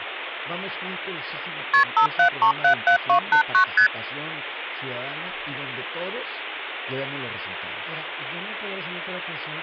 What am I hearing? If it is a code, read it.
Multi-frequency trunk signalling (R1, as on North American trunks), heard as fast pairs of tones, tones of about 100 ms, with phone line noise. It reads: KP 57377289 ST